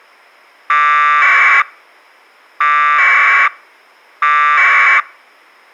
Packet radio (AX.25, as in APRS), 1200 baud, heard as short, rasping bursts.